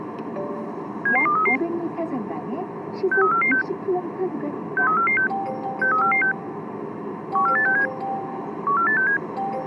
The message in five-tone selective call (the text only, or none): 77233 63446 63446 63446 14867 14867